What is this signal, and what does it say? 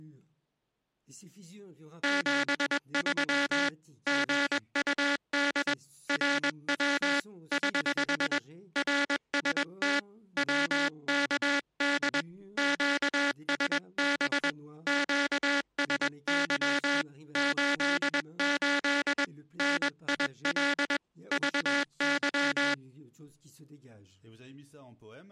Morse code, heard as a buzzer, hand-sent with a paddle, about 21 wpm. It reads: 73 GUD RW <HH> RST WKD QSB QSY 88 NIL VY